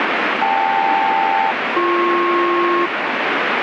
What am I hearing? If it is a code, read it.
Aircraft SELCAL, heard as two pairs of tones, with heavy radio static. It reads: KL-BP